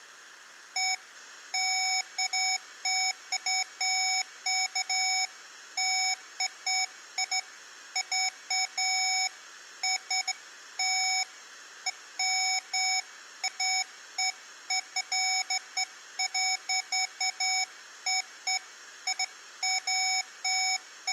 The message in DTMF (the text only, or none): none